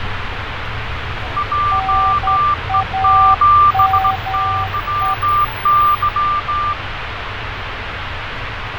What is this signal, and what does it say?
Morse code, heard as two keyed tones, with radio static, fading and street noise. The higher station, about 16 wpm, 1180 Hz: JE7YY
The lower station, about 10 wpm, 770 Hz: NAME